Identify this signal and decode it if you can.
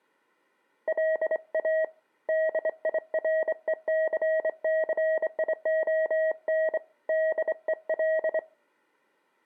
Morse code, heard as a keyed tone, hand-sent with a straight key, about 25 wpm, 640 Hz. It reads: LA DIRECCION DEL